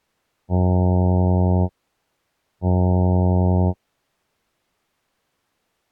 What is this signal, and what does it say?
Ship horn signal, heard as a ship's horn, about 90 Hz. 2 short. At sea: I am altering course to port.